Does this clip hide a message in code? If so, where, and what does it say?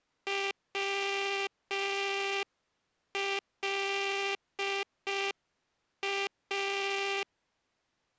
Yes: Morse code (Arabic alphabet) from 0.2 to 7.3 s, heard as a buzzer, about 5 wpm. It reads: ولا